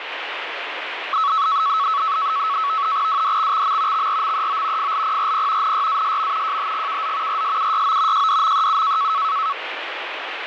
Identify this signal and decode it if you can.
NAVTEX (SITOR-B), 100 baud, 170 Hz shift, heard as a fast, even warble, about 1210 Hz centre, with radio static. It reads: WDXXM XRMEO FLPRP NYASM JHGKZ RSUYO JDMEU